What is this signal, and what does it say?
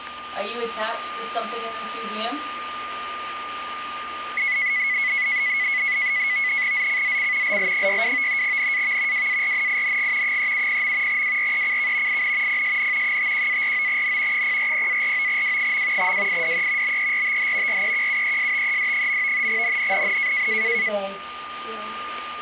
NAVTEX (SITOR-B), 100 baud, 170 Hz shift, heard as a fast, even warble, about 2100 Hz centre, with static crashes and a steady whistle near 1210 Hz. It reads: ZCZC LL62 NAV WARNING 370. WRECK IN PSN 51-49N 040-49W. WIDE BERTH REQUESTED. NNNN